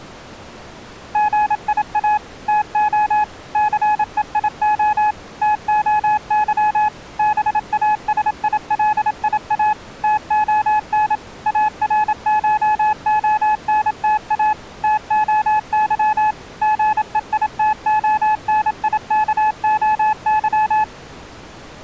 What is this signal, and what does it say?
Morse code (Greek alphabet), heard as a keyed tone, machine-sent, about 27 wpm, 850 Hz. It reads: ΓΙΑ ΤΟ ΘΕΙΟ ΤΟΥ ΒΑΣΙΛΙΑ ΤΟΝ ΑΡΧΟΝΤΑ ΤΟΥ ΓΕΙΤΟΝΙΚΟΥ